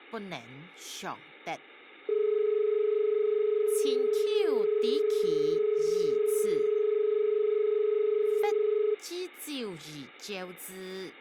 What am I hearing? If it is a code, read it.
Telephone call progress tone (as in Australia), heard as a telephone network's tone, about 430 Hz. Dial tone.